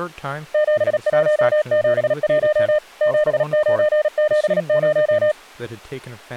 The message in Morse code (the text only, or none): 7171 7970